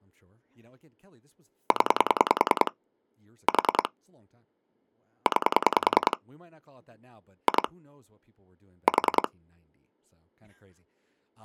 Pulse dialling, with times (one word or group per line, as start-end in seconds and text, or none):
1.7-2.7 0
3.5-3.9 4
5.3-6.2 9
7.5-7.7 2
8.9-9.3 4